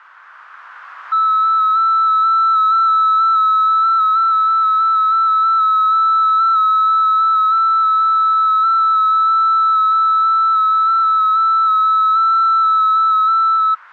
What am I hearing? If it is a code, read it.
FT8 (one signal), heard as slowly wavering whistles, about 6.25 baud, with static crashes.